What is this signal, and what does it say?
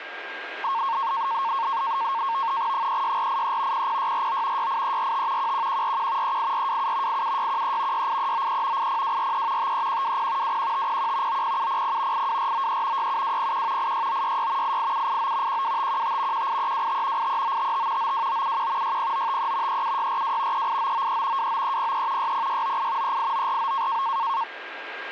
NAVTEX (SITOR-B), 100 baud, 170 Hz shift, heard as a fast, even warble, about 1000 Hz centre, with radio static and a steady whistle near 1610 Hz. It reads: 36483 00649 68345 11141 38427 87613 68393 80243 53120 21501 90700 82493 67201 86966 88789 12515 18325 83955 92971 60953 37642 38993 29303 60698 38949